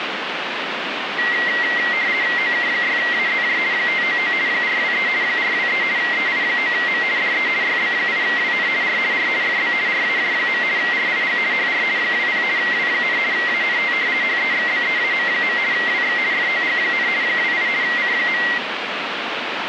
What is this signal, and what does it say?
RTTY (50 baud, 170 Hz shift), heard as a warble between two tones, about 2000 Hz centre, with radio static. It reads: OK6AZJ 599 423 423 EI9M DE YB8WN R R FB RAJ. RIG HR 20 W, ANT HEXBEAM. WX FOG, 28 C.